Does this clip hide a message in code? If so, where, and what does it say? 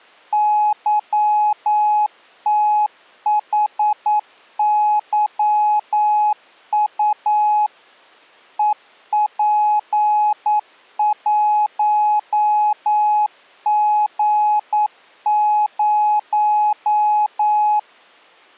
Yes: Morse code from 0.3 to 17.9 s, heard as a keyed tone, machine-sent, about 9 wpm, 840 Hz. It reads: YTHYU EP1G0